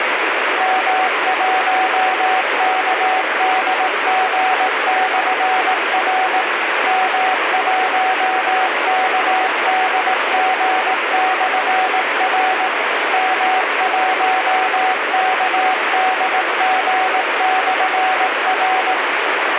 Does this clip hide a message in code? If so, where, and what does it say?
Yes: Morse code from 0.5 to 19.0 s, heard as a keyed tone, machine-sent, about 18 wpm, 750 Hz, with heavy radio static. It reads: M1KDG/R M1KDG/R M1KDG/R